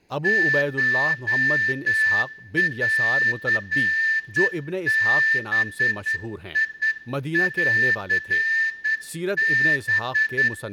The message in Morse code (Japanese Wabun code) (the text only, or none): コンバンハ